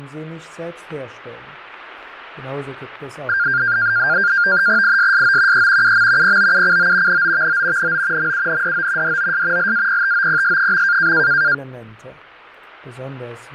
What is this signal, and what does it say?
NAVTEX (SITOR-B), 100 baud, 170 Hz shift, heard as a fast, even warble, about 1500 Hz centre. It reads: ISSO E UM POUCO NOVO NO MUNDO DOS LAPTOPS.